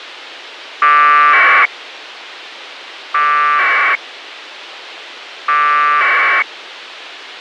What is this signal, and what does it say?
Packet radio (AX.25, as in APRS), 1200 baud, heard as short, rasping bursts, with radio hiss and a squelch burst at the end.